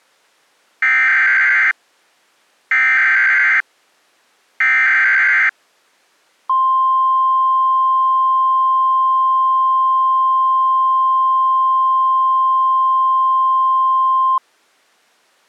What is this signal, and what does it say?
Emergency Alert System (SAME) tones (header bursts, then the 1050 Hz attention tone), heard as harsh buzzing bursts, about 520.83 baud.